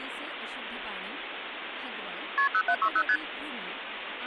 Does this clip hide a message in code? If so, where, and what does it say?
Yes: multi-frequency trunk signalling (R1, as on North American trunks) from 2.4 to 3.2 s, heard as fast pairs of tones, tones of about 70 ms, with phone line noise and speech in Marathi. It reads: KP 0760 ST